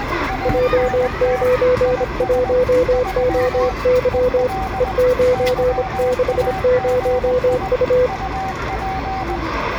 Morse code, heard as two keyed tones, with radio static, room echo and the noise of a residential street. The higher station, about 20 wpm, 760 Hz: ANT IS 3 EL YAGI UP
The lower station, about 26 wpm, 500 Hz: J91OY E960U